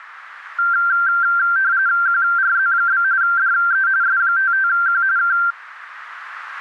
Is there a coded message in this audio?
Yes: RTTY (45.45 baud, 170 Hz shift) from 0.6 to 5.5 s, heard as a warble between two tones, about 1470 Hz centre, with radio static. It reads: QRZ? DE S55Q K